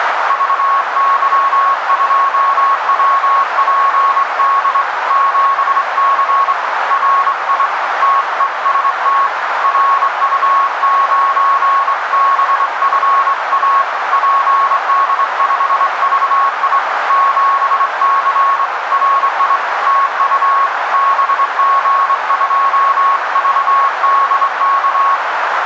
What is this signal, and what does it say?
Morse code, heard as a keyed tone, hand-sent with a straight key, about 24 wpm, 1100 Hz, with radio static and a narrow filter. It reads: VY2WPD 7C RI TEST RU9BFA PD5VI 7C RI TU BG2VDK